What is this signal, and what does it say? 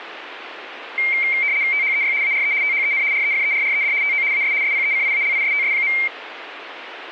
RTTY (75 baud, 170 Hz shift), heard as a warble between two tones, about 2200 Hz centre, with radio static. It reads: THEY ARE THEN REFERRED TO AS SPECIALISTS.